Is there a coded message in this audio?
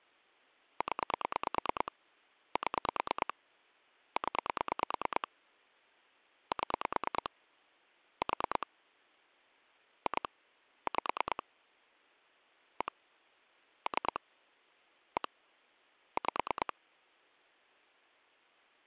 Yes: pulse dialling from 0.8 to 16.7 s, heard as clicks on a phone line, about 9 pulses a second. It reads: 0 7 0 7 4 2 5 1 3 1 5